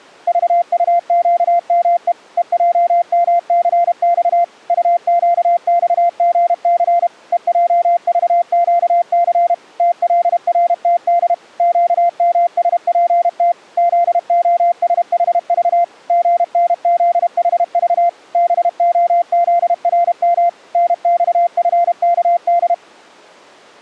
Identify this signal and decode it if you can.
Morse code, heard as a keyed tone, machine-sent, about 32 wpm, 690 Hz. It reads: VUQME EJMCX UQXGC EJVQC TLRTD QMSPT ZOSHV GNZHV BOZRM NXFKD